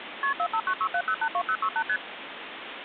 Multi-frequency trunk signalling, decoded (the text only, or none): KP 45967082068 ST